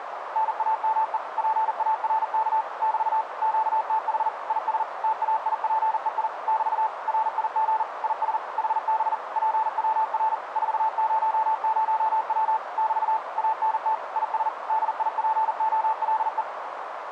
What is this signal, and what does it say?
Morse code, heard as a keyed tone, machine-sent, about 40 wpm, 880 Hz, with radio static and a narrow filter. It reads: NAME PARK <BT> QTH IS TAIPEI <BT> RIG IS HB PWR 400W <BT> ANT IS DIPOLE